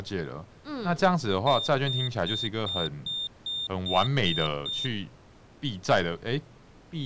Beep code, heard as a piezo beeper, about 3600 Hz, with speech in Chinese. 9 short. In AMI BIOS tables: ROM checksum failure.